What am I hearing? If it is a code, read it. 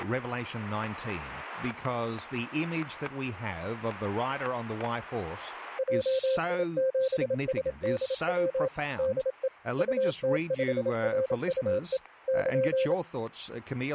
Morse code, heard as a keyed tone, machine-sent, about 27 wpm, 520 Hz, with static crashes and speech in English. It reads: JI7SDW DE UT5RUE <KN>